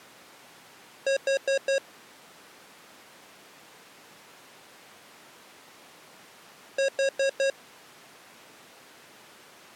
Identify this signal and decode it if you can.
Alarm pattern, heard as an alarm's beeps, played twice, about 540 Hz. Temporal four. Carbon monoxide.